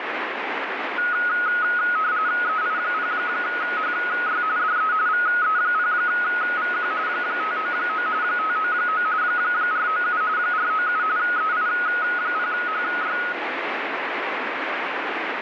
RTTY (45.45 baud, 170 Hz shift), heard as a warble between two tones, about 1360 Hz centre, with radio static. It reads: EI0HY DE VE0VQ 599 599 497 497 EI0HY